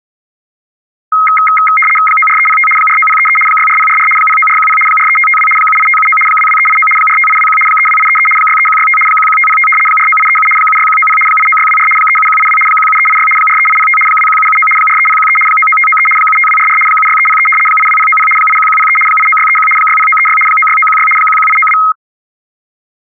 RTTY (75 baud, 850 Hz shift), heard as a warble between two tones, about 1700 Hz centre. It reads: 94305 49033 64044 09410 43552 78579 22389 45821 32833 63165 11505 49837 76190 89624 37182 17386 43805 21779 43013 99593 75244 76303 82090 81103 89631 60936 96916 11892